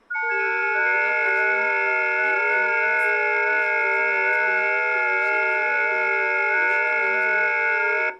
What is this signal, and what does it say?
FT8 (several signals at once), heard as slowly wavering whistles, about 6.25 baud, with speech in Bangla.